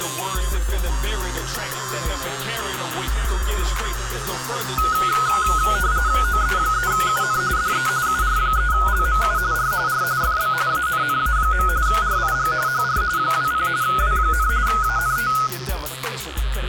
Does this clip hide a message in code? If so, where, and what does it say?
Yes: RTTY (45.45 baud, 170 Hz shift) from 4.8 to 15.5 s, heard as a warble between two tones, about 1360 Hz centre. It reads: OE3UN DE UR3LMU R R FB ANNA. RIG HR 20 W, ANT